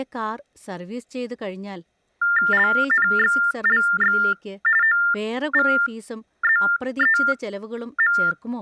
TTY/TDD text telephone tones (45.45 baud Baudot), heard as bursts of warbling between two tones, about 400 Hz shift, 1600 Hz centre, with speech in Malayalam. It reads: LNXLX OVZEM